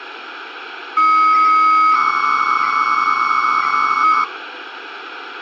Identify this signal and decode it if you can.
300-baud modem data (Bell 103 tones), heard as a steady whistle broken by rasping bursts, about 300 baud, 200 Hz shift, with phone line noise.